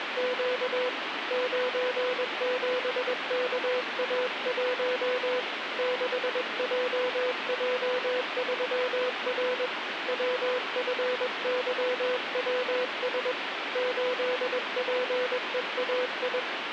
Morse code, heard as a keyed tone, hand-sent with a paddle, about 21 wpm, 500 Hz, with radio static. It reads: … 97KA1 6JJ3R WFYWS 8PEAI